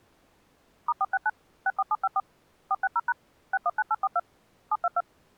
DTMF, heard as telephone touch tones, dialled by machine, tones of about 40 ms. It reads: *469 64754 460# 619842 722